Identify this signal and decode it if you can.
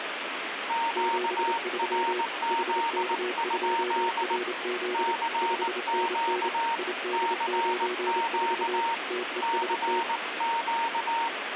Morse code, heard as two keyed tones, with radio static. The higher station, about 19 wpm, 920 Hz: QRZ? CQ CQ CQ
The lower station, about 28 wpm, 360 Hz: 73 HK2RZ 5NN ID94 TEST